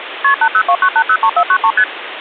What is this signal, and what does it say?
Multi-frequency trunk signalling (R1, as on North American trunks), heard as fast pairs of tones, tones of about 70 ms, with phone line noise. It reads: KP 8029803493 ST